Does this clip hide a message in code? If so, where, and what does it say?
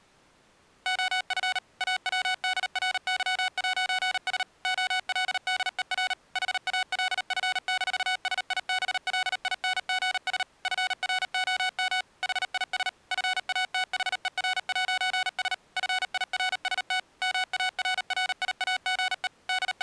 Yes: Morse code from 0.8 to 19.8 s, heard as electronic beeps, machine-sent, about 38 wpm, 740 Hz. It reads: OF AWDRY'S OLDER HALF-SIBLINGS FROM HIS FATHER'S FIRST MARRIAGE …